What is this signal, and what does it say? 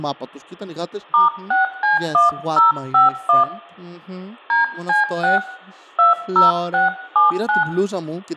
DTMF, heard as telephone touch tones, dialled by hand, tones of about 150 ms, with room echo and speech in Greek. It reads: *6C1051 DC6 20679